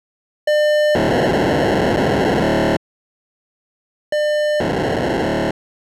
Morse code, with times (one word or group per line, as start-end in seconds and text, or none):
none